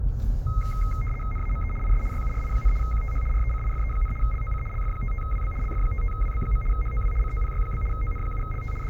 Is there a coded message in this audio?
Yes: RTTY (75 baud, 850 Hz shift) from 0.5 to 8.9 s, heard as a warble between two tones, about 1700 Hz centre, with the noise inside a car. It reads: NAME IS YURI, QTH RECIFE, LOC LF55WB LF55WB. HOW COPY? ON7LT …